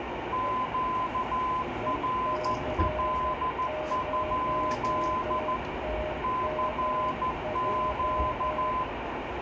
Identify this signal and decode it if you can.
Morse code, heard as two keyed tones, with radio static, room echo and the noise inside a subway train. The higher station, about 14 wpm, 1020 Hz: QRL? CQ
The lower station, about 12 wpm, 620 Hz: EC0TMJ